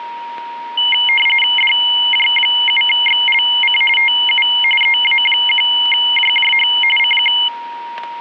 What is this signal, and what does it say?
RTTY (45.45 baud, 850 Hz shift), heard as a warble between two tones, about 2550 Hz centre, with a steady whistle near 940 Hz. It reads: DJ7XLC TU EA1JJH CQ